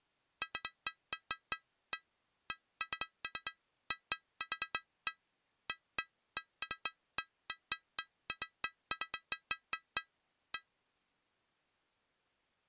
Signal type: none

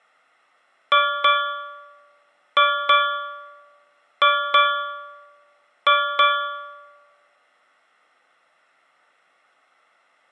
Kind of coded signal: ship's bell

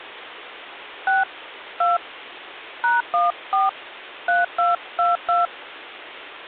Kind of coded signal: DTMF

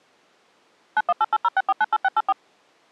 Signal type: DTMF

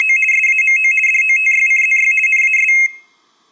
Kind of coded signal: RTTY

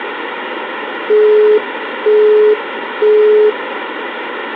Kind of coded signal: telephone call progress tone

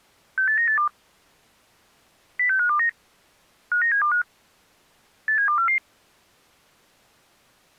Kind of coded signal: five-tone selective call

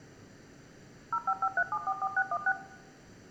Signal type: DTMF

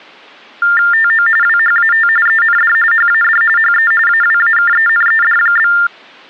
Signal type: TTY/TDD text telephone tones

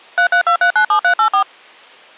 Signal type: DTMF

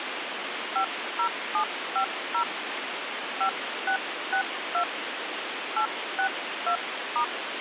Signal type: DTMF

